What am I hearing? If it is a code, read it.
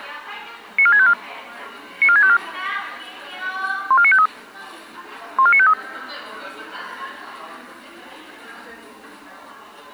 Five-tone selective call (ZVEI), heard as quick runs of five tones, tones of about 70 ms, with the noise of a cafe. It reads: 94654 94654 14953 14953